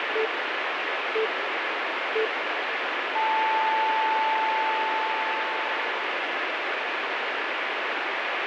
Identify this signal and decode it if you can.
Radio time signal (three low pips and a long one an octave up, as on NHK), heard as pips, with radio static.